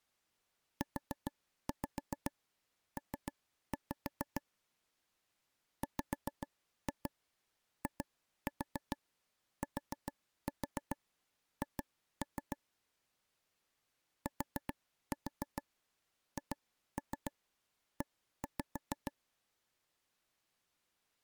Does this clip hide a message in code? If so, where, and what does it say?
Yes: tap code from 0.8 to 19.1 s, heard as taps on a table, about 7 knocks a second. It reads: UP WITH THE